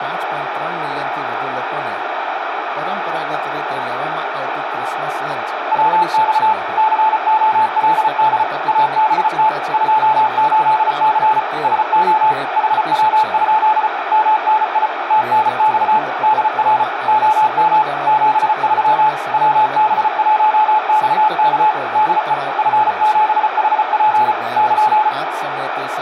Morse code, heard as a keyed tone, machine-sent, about 34 wpm, 860 Hz, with radio static, a narrow filter and speech in Gujarati. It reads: WX COLD ABT 28C SO HW? MNI TNX DR OM 73 WB1XK DE F7HP <KN>